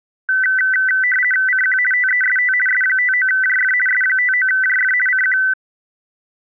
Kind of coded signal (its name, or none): RTTY